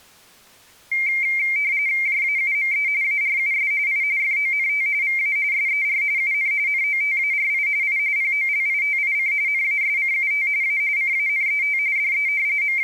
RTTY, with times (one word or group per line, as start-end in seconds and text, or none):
2.1-2.9 JAUME
3.0-3.7 ARUS
3.9-4.0 I
4.2-4.9 FONT
5.0-5.4 VA
5.5-6.0 SER
6.2-6.5 UN
6.7-7.7 NOTARI
7.8-8.0 I
8.2-9.3 POLITIC
9.5-10.5 NASCUT
10.6-10.8 A
11.0-11.8 CANET
12.0-12.3 DE
12.6-12.8 …